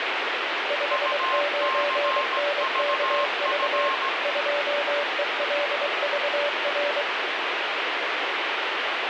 Morse code, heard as two keyed tones, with heavy radio static. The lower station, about 23 wpm, 580 Hz: 59NKV 2ELVR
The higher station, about 17 wpm, 1060 Hz: UCVF